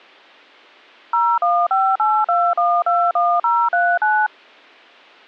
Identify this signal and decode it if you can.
DTMF, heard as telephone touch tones, dialled by machine, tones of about 250 ms. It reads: 01582121039